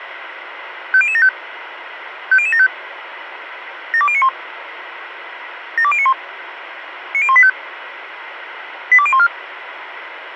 Five-tone selective call (ZVEI), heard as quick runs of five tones, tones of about 70 ms, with radio hiss. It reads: 50075 50075 72091 72091 90185 82014